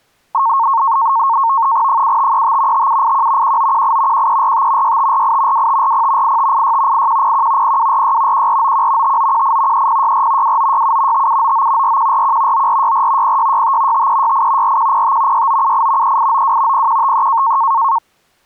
NAVTEX (SITOR-B), 100 baud, 170 Hz shift, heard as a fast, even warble, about 1000 Hz centre. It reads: 7535 5781 1918 1345 6548 2540 8586 8101 0246 1491 5918 3064 2967 5799 4141 9464 0665 5368 4105 6978 3892 0153